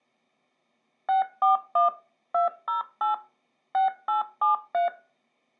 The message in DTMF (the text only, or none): 641 208 6873